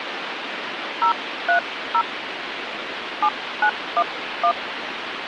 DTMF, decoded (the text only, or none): 030 7911